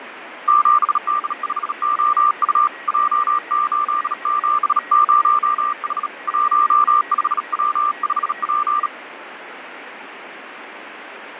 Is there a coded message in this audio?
Yes: Morse code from 0.4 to 8.9 s, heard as a keyed tone, hand-sent with a bug key, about 37 wpm, 1190 Hz, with radio static, fading and a weaker station near 1910 Hz. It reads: 7D5OU J870H 15W5P